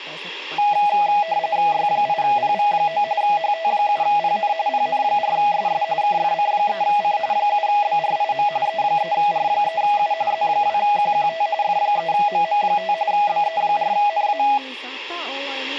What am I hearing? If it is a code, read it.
RTTY (45.45 baud, 170 Hz shift), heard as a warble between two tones, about 740 Hz centre, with speech in Finnish. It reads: Y8PV9 HT7PN PN4SS KFC3C 7BRIM E3R3U Z2QQT F3MM5 BE4NA